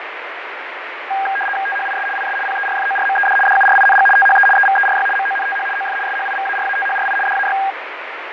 RTTY (75 baud, 850 Hz shift), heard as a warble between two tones, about 1200 Hz centre, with radio static and fading. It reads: THIS IS PERFORMED DURING THE EVERY MONTH OF SHIVARATHRI DAY